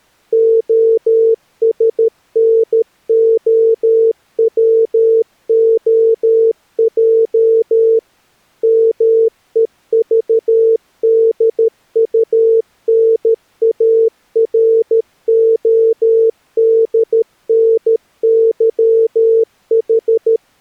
Morse code (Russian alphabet), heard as a keyed tone, machine-sent, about 13 wpm, 450 Hz. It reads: ОСНОВОЙ МЕЖДУНАРОДНЫХ